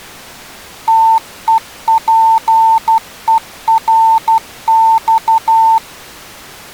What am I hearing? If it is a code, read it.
Morse code (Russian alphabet), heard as a keyed tone, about 12 wpm, 900 Hz. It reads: ТЕПЕРЬ